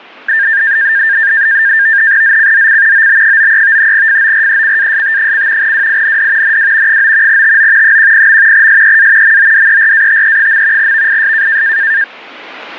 NAVTEX (SITOR-B), 100 baud, 170 Hz shift, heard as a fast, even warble, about 1700 Hz centre. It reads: ZCZC OB93 FORECAST: WIND NW 9 TO 10. SEA MODERATE. VIS